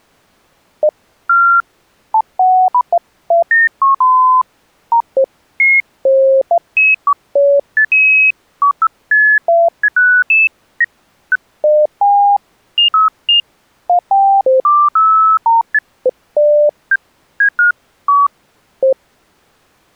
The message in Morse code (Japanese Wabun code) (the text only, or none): none